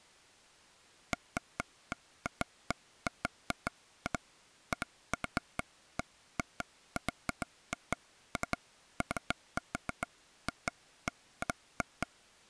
Irregular taps on a table. There is no code.